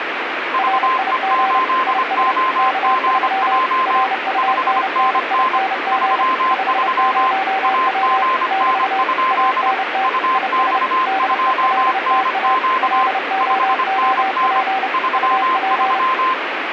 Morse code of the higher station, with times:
0.5-4.0 VE8OGJ
4.4-5.6 5NN
5.9-7.3 33
7.6-9.7 AGN?
10.0-13.1 UX2NQ
13.4-14.6 5NN
14.9-16.3 33

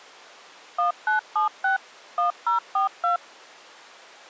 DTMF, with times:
0.8-1.8 1976
2.2-3.2 1042

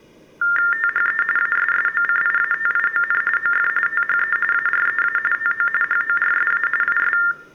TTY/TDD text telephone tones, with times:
0.7-1.2 THE
1.4-3.2 ASSOCIATION
3.4-3.7 OF
3.9-4.4 THE
4.5-5.2 AREA
5.3-5.7 TO
5.8-6.7 HORSA
6.8-7.2 IS

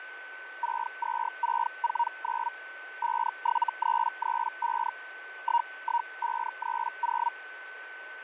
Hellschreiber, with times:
0.6-2.5 62649
3.0-4.9 57335
5.4-7.3 11530

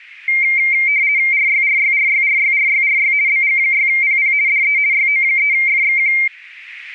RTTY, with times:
1.3-3.1 RYRYRYRYRYRY
3.3-4.3 BG6PP
4.5-4.8 DE
4.9-6.1 YO3FXQ

